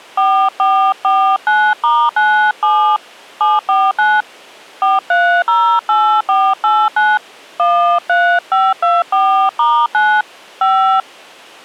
DTMF, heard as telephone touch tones, dialled by hand, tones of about 280 ms. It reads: 4449*97 749 4308489 13524*9 5